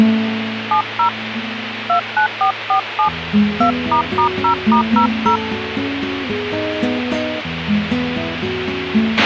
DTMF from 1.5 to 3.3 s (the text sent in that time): 29447